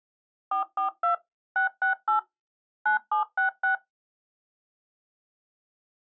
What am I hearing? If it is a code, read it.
DTMF, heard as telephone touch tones, dialled by machine, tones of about 120 ms. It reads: 442 668 9766